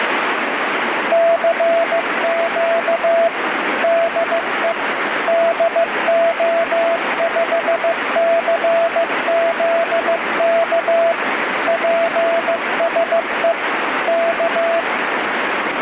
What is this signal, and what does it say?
Morse code, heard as a keyed tone, machine-sent, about 15 wpm, 670 Hz, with heavy radio static. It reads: CQ DE DO5CZK PSE K